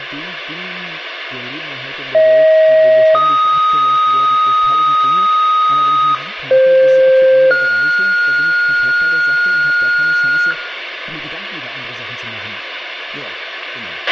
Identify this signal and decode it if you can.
Two-tone page, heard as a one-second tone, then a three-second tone, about 630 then 1250 Hz, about 520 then 1430 Hz, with radio hiss, a squelch burst at the end, room echo and speech in German.